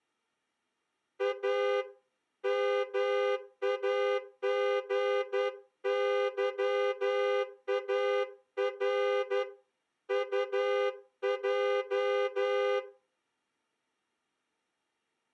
Morse code, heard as a horn, hand-sent with a straight key, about 11 wpm. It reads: A MAGYAR UJ